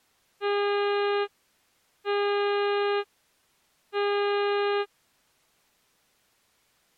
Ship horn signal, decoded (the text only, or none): 3 short